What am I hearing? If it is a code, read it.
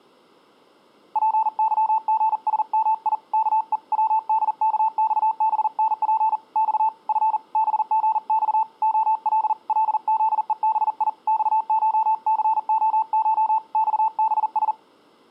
Morse code (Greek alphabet), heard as a keyed tone, hand-sent with a paddle, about 40 wpm, 890 Hz. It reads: ΠΥΓΣΜΙ ΚΕ ΩΔΚΞΒΝΠ Ξ Φ ΒΓΞ ΟΛ ΛΖΕΒΙ ΞΧΘΟΧ ΞΒΣ